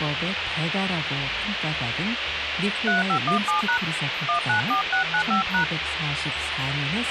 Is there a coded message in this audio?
Yes: DTMF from 2.9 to 5.6 s, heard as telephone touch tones, dialled by hand, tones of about 120 ms, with radio hiss and a squelch burst at the end. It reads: 3517# 194695#